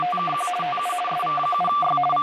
RTTY (50 baud, 450 Hz shift), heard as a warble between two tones, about 940 Hz centre, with radio static and speech in English. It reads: … TU SV7Y …